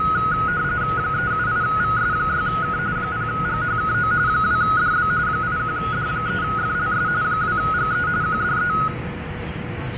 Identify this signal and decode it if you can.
RTTY (45.45 baud, 170 Hz shift), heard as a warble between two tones, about 1360 Hz centre, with radio static, fading, a steady whistle near 490 Hz, room echo and the noise inside a subway train. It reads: 378VS6K 0GHKO 2DB 81D3FLS 2GE QDE